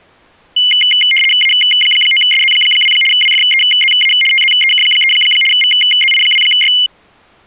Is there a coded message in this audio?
Yes: RTTY (75 baud, 850 Hz shift) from 0.6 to 6.9 s, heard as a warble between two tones, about 2550 Hz centre. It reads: A9SZ2 WFEZA TZEK3 VZI2Y